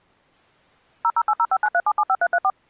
DTMF, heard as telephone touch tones, dialled by machine, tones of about 50 ms. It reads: 0080593775334